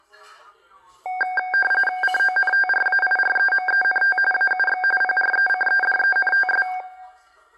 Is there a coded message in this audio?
Yes: RTTY (45.45 baud, 850 Hz shift) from 1.1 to 6.8 s, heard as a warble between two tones, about 1160 Hz centre, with the noise of a crowd indoors. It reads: CONTRAIREMENT AUX PRECEDENTS